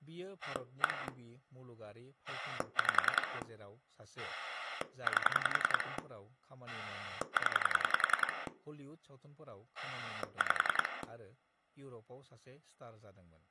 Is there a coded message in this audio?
Yes: pulse dialling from 0.4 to 11.0 s, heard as a rotary dial, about 10 pulses a second, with speech in Bodo. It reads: 1 5 8 0 5